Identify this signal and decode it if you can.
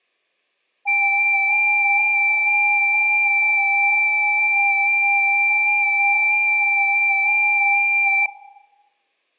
FT8 (several signals at once), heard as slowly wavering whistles, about 6.25 baud.